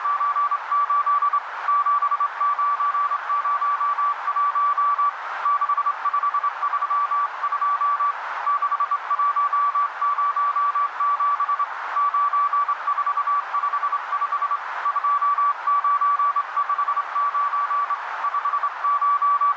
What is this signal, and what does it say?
Morse code, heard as a keyed tone, hand-sent with a straight key, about 26 wpm, 1150 Hz, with radio static and a narrow filter. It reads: … 7901 6532 6107 9455 2959 …